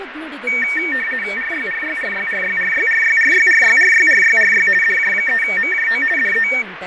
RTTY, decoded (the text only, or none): RYRYRYRYRYRYRYRYRYRYRY DJ3MJO DE